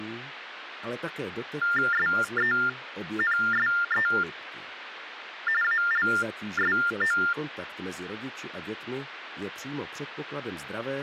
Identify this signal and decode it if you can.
TTY/TDD text telephone tones (45.45 baud Baudot), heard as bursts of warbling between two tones, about 400 Hz shift, 1600 Hz centre, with phone line noise. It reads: SENSE ALSO